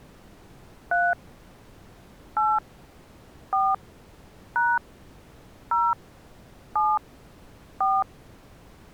DTMF, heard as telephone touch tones, dialled by hand, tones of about 220 ms. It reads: 3 8 4 # 0 7 4